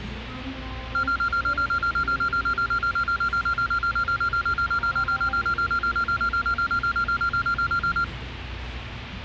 Evenly repeated beeps, with the noise of a cafe. There is no code.